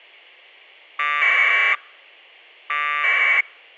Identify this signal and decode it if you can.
Packet radio (AX.25, as in APRS), 1200 baud, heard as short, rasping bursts.